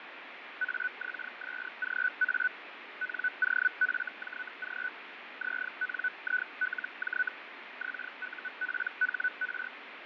Hellschreiber (Feld-Hell, 122.5 baud), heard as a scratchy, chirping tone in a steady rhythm, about 1500 Hz, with radio static and fading. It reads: AXSGA NOFJG ZNILJ XUPHR